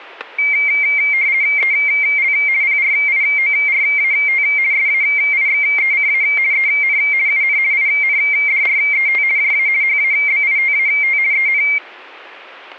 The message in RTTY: EL PRIORAT SAIXECA EN UN INDRET JA HABITAT EN

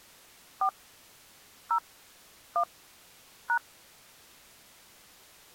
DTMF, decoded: 4 0 1 #

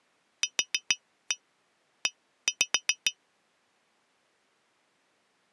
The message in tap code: QE

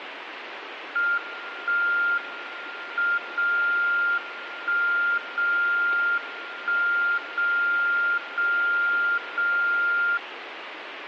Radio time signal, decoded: 1 M 0 1 0 1 0 0 0

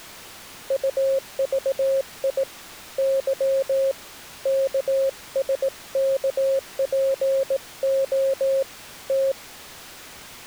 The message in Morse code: UVI Y KSKPO T

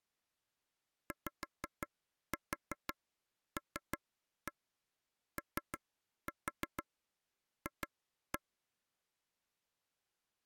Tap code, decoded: YLOF

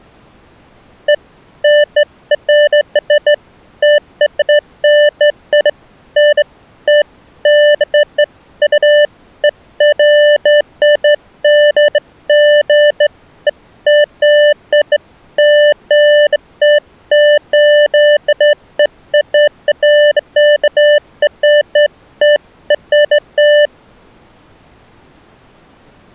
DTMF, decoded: none

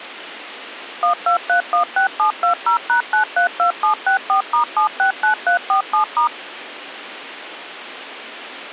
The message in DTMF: 12316720#932764*769347*

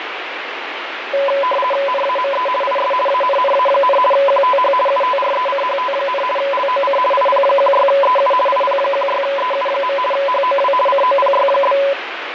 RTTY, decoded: NAME IS ANNA, QTH UTRECHT, LOC IP16EU IP16EU. HOW COPY?

